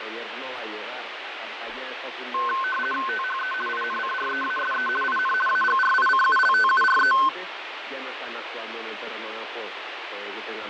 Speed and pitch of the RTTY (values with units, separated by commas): 50 baud, 450 Hz shift, 1290 Hz centre